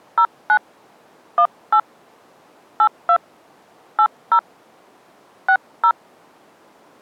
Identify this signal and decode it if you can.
DTMF, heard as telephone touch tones, dialled by hand, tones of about 70 ms. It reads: 09 18 82 80 60